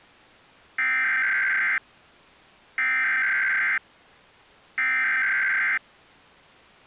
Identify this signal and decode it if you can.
Emergency Alert System (SAME) tones (header bursts), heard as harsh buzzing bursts, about 520.83 baud.